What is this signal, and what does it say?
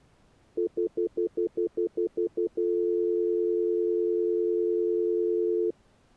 Telephone call progress tone (North American plan), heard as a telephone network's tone, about 350, 440 Hz, 0.1 s on and 0.1 s off. Stutter dial tone.